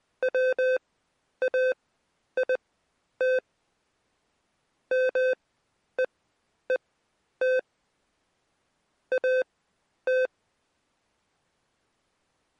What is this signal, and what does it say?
Morse code, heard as electronic beeps, machine-sent, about 20 wpm, spaced as for 10 wpm, 510 Hz. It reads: WAIT MEET AT